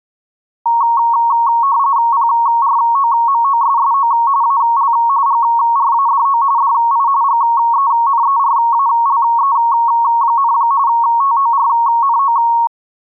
RTTY (45.45 baud, 170 Hz shift), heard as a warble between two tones, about 1020 Hz centre. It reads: PROMOSSO AL GRADO DI GENERALE, TORNO